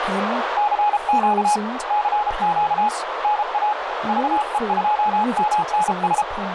Morse code, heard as a keyed tone, hand-sent with a paddle, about 33 wpm, 840 Hz, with heavy radio static, a narrow filter and speech in English. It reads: CQ CQ NA VE2MNS